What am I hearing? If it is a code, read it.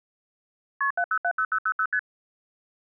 Multi-frequency trunk signalling (R1, as on North American trunks), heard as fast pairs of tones, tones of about 70 ms. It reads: KP 7070000 ST